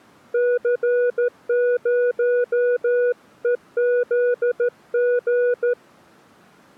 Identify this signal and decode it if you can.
Morse code, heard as a keyed tone, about 13 wpm, 490 Hz. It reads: C0EZG